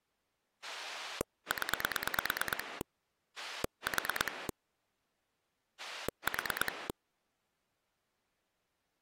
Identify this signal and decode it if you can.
Pulse dialling, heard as a rotary dial, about 9 pulses a second. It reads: 0 4 4